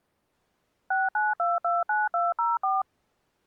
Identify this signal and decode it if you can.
DTMF, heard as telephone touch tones, dialled by machine, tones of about 180 ms. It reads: 69229204